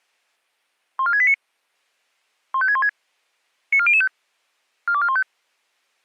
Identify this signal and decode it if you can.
Five-tone selective call (ZVEI), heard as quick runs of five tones, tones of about 70 ms. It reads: 14689 15616 94005 42415